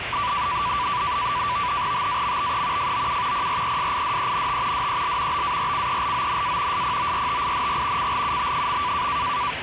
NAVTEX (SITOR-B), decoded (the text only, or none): TAMBE FOU PRESIDENT DEL BARCELONA SPORTING CLUB.